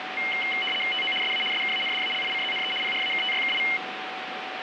RTTY (75 baud, 850 Hz shift), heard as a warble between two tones, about 2550 Hz centre, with radio static and a steady whistle near 750 Hz. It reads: TO SA SKANDALICZNE PRAKTYKI